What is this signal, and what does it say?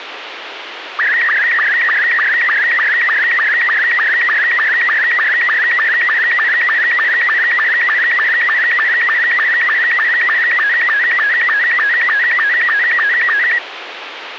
SSTV (slow-scan television), Robot 72, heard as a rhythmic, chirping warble, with radio hiss and a squelch burst at the end.